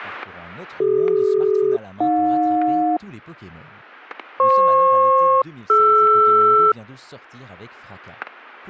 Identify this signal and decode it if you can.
Aircraft SELCAL, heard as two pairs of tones, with static crashes and speech in French. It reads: CD-AJ FP-DR